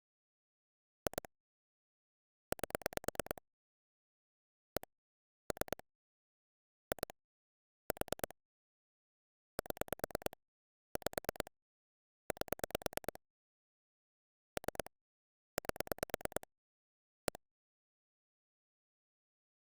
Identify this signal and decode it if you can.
Pulse dialling, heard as clicks on a phone line, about 9 pulses a second. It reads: 2 8 1 3 2 4 7 5 8 3 8 1